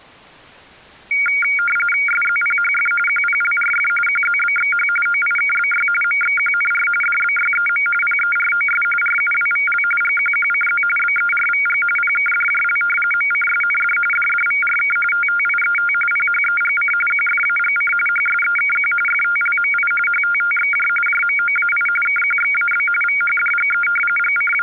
RTTY (45.45 baud, 850 Hz shift), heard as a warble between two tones, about 1850 Hz centre. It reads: SZPHF QPLRF QZBXH OIKBY MXQNR DBYEM PEROS RUWVL GQQCZ BERVG PKDJL MCSND DDVRK TTIET PHEGC QFAGC HSEKQ FTLMI HTTXJ JMOAI KQXAB VHDGE …